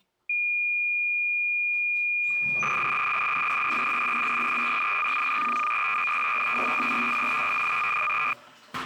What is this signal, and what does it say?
Cassette data (Kansas City type), 300 baud, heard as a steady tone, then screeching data, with the noise of a restroom.